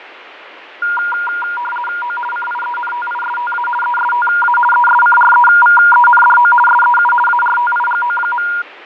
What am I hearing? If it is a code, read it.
RTTY (50 baud, 450 Hz shift), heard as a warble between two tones, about 1190 Hz centre, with radio static and fading. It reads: O CIENTISTA ESTA ESCREVENDO SEU ARTIGO.